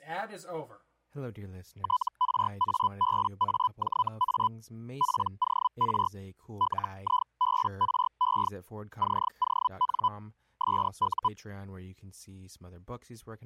Hellschreiber (Feld-Hell, 122.5 baud), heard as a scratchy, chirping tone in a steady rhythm, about 1000 Hz, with speech in English. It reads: TRABAJA POR LIBRE CON SU